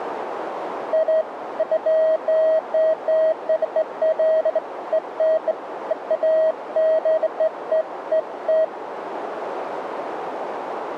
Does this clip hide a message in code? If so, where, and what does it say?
No, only beeps of irregular length, with radio static and a narrow filter.